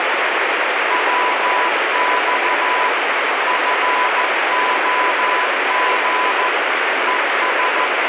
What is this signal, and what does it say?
Morse code, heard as a keyed tone, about 14 wpm, 1000 Hz, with heavy radio static. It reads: WX FOG ES